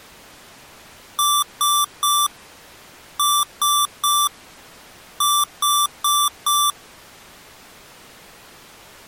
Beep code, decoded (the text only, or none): 3-3-4